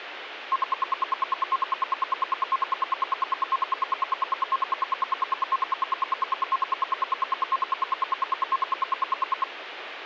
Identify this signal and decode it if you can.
Radio time signal (RWM, Moscow), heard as ten pulses a second, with radio static.